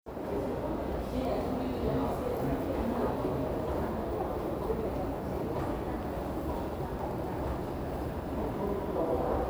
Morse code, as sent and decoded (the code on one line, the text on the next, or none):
none